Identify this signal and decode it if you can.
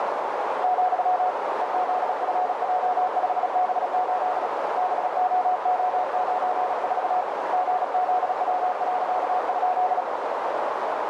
Morse code, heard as a keyed tone, hand-sent with a paddle, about 36 wpm, 730 Hz, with heavy radio static and a narrow filter. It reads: , EZFJ5B8 BOO94 GZW.?